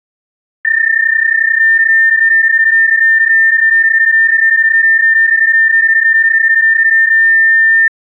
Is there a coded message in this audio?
Yes: PSK31 (31.25 baud) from 0.6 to 7.9 s, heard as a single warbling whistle, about 1800 Hz.